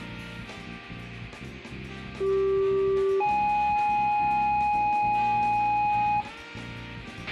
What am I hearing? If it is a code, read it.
Two-tone page, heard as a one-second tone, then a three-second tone, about 390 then 830 Hz, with a squelch burst at the end and room echo.